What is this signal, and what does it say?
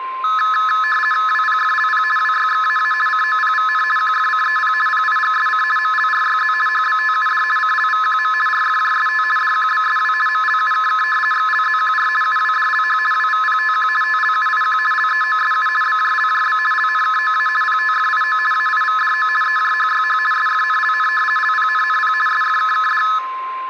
RTTY (50 baud, 450 Hz shift), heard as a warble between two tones, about 1500 Hz centre, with a steady whistle near 1050 Hz and room echo. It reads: WPFLP WYXAA COPVN QFCEP PIGSC MLRYZ HBTUD CLVQM RFJST DQBSW MLUKK XLZQR UWDLH WVPTQ TLUIQ LEOSU BJLJB LNKOA PTFIO AIVDO EJHYH SFNLN LPNNP SFKKD